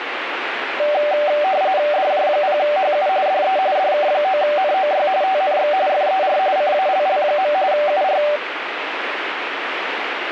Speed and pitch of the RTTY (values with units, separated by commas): 45.45 baud, 170 Hz shift, 680 Hz centre